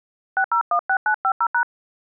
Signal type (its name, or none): DTMF